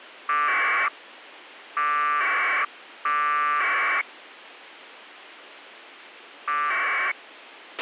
Packet radio (AX.25, as in APRS), 1200 baud, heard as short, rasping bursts, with a squelch burst at the end.